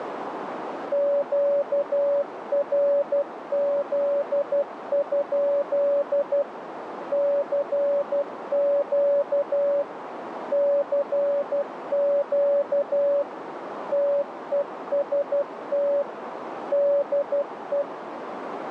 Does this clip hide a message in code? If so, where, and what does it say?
Yes: Morse code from 0.9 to 17.9 s, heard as a keyed tone, machine-sent, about 12 wpm, 570 Hz, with radio static and a narrow filter. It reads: QRZ? CQ CQ TEST DE